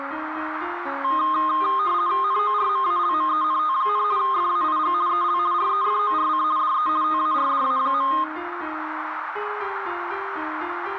RTTY (50 baud, 170 Hz shift), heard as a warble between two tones, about 1150 Hz centre, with radio static and a narrow filter. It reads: NORMALMENT, FAIG EL REFORC DE TARDA.